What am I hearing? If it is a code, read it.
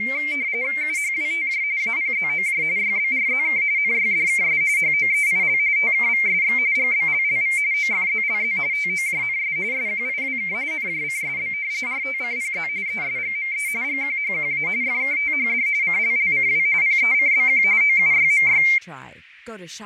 RTTY (45.45 baud, 170 Hz shift), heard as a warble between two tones, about 2200 Hz centre, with radio static, fading and speech in English. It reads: UHWTJ APZOJ YBRZK NYDKS HOEIL TKVSX GBLLV OFZLZ TOJNS SQIWK NJCSB RTCPZ ESGME GQHQA FKTHD CLLCW PECBQ OUYMY